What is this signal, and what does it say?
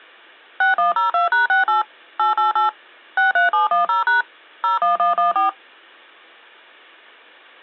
DTMF, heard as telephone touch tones, dialled by machine, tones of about 140 ms. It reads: 6102#68 888 63710# 01114